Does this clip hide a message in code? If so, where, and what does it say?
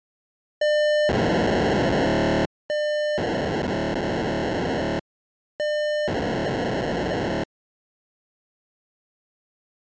Yes: POCSAG pager data (1200 baud) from 0.6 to 7.4 s, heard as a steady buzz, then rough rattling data.